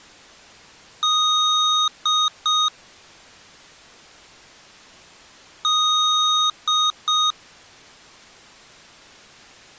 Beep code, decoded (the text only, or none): 1 long, 2 short